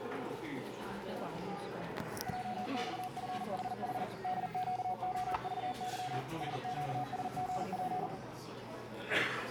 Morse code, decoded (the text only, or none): JXFHH DQOVY SQSGP